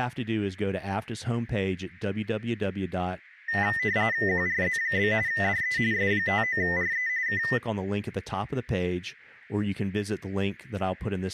RTTY (45.45 baud, 170 Hz shift), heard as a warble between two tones, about 1900 Hz centre, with speech in English. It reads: QRZ? DE S59RE K